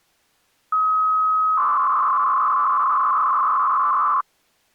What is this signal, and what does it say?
300-baud modem data (Bell 103 tones), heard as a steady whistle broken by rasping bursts, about 300 baud, 200 Hz shift.